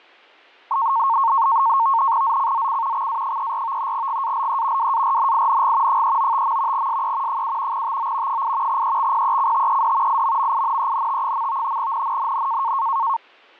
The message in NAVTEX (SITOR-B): ZCZC XA34 GALE WARNING 395. SE 7 TO 8 EXPECTED IMMINENT. NNNN

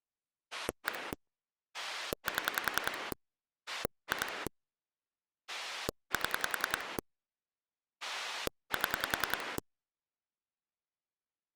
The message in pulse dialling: 1 7 2 7 7

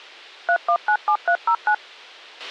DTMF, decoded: 3197309

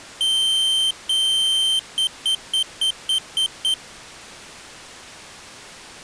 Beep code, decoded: 2 long, 7 short

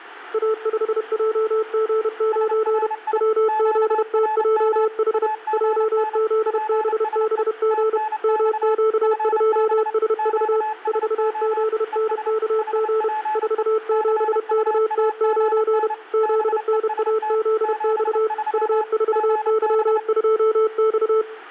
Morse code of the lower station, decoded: A5JG9 WZTJH JZBBG MQ2SV 4ZNKG 47KT9 ZNAZX U4Y2X

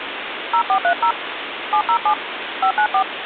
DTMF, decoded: 0430 707 594

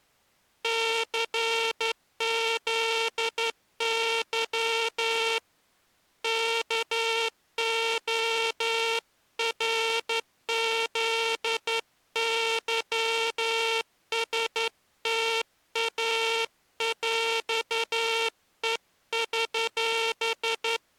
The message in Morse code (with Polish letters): CZY KORZYSTAŁEŚ

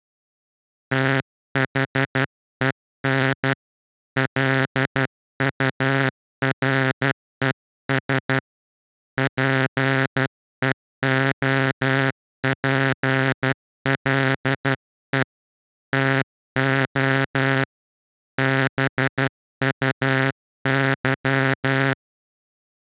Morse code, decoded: THEN LURES PEOPLE TO BUY

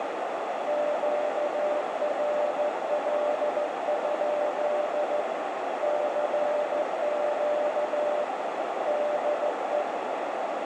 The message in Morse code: QRL? CQ DE

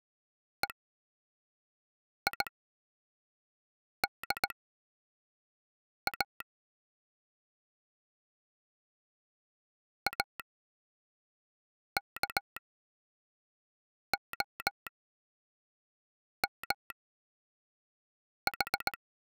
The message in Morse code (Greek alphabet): ΕΙΔΑ ΑΚΟΜΗ

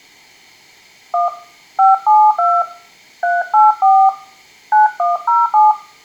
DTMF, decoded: 1 572 384 9107

